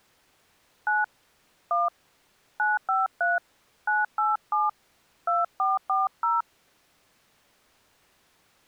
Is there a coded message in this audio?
Yes: DTMF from 0.9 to 6.4 s, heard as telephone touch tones, dialled by hand, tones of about 180 ms. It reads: 9 1 953 987 2440